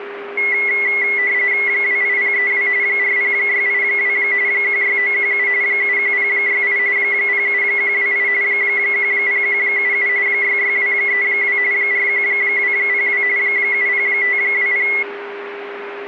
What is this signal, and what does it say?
RTTY (45.45 baud, 170 Hz shift), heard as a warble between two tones, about 2050 Hz centre, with radio static and a steady whistle near 400 Hz. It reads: 28032 40682 16917 71068 07128 10177 66232 41202 70520